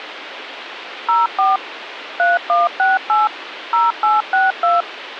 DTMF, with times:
1.1-1.6 04
2.2-3.3 3168
3.7-4.8 0862

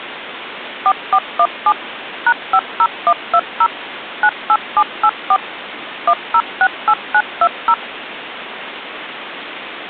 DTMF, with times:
0.9-1.7 4417
2.3-3.7 #50120
4.2-5.4 98784
6.1-7.7 1068920

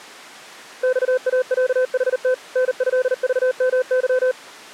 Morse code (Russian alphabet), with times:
0.8-2.3 ЬАЯХТ
2.6-4.3 НЭЖМЫ

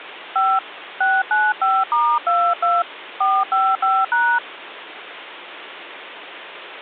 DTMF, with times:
0.4-0.6 5
1.0-2.8 695*22
3.2-4.4 455#

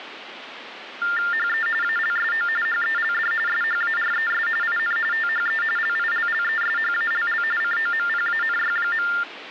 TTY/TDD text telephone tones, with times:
1.3-1.7 HE
1.8-2.5 ALSO
2.7-3.3 HELD
3.5-4.5 SHARES
4.6-5.0 IN
5.1-5.6 THE
5.8-7.4 LILLESHALL
7.6-9.1 COMPANY.

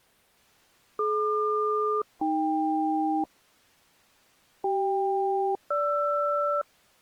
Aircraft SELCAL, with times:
1.0-3.2 DQ-AK
4.6-6.6 CK-GR

